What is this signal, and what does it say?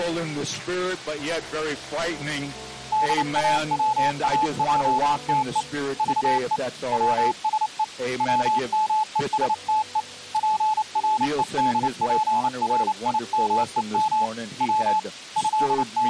Morse code (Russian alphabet), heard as a keyed tone, hand-sent with a paddle, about 29 wpm, 860 Hz. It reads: ДАВАЙТЕ ЖЕ ВСЕ ВМЕСТЕ ПРЕДПРИМЕМ В …